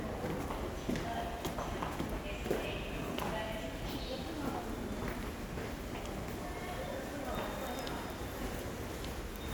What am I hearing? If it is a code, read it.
The noise of a subway station. There is no code.